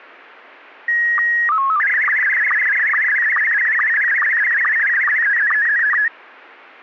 SSTV (slow-scan television), Scottie S1, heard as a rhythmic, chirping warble.